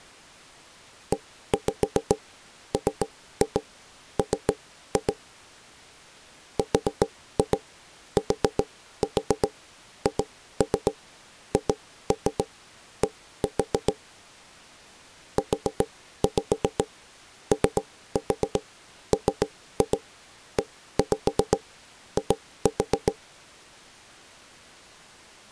Tap code, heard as knocks on wood, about 7 knocks a second. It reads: EMM RTHHD UOMEI